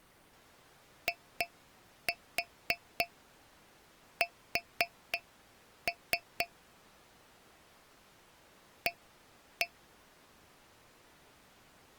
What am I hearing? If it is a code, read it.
Tap code, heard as taps on a metal pipe, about 3 knocks a second. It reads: IS A